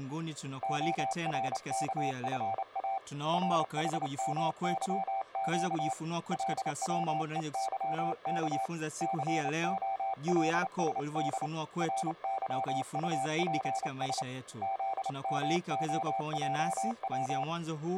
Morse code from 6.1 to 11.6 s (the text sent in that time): LWEYK COLSD